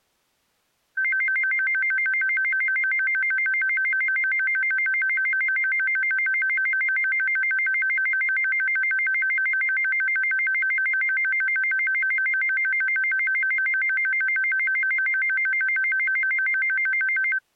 A tone that alternates evenly between two pitches. There is no code.